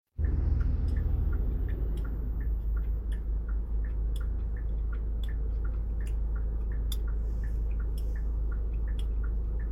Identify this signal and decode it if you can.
The noise inside a car. There is no code.